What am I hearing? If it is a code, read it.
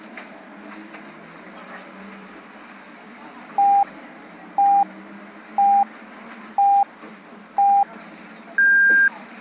Radio time signal (five pips and a higher one, as on Chinese radio), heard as pips, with the noise inside a bus.